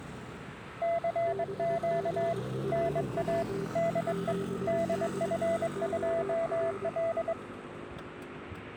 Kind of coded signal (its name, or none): Morse code